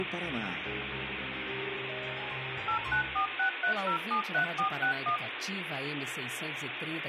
DTMF, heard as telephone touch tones, dialled by machine, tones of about 100 ms, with phone line noise and room echo. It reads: 89463073461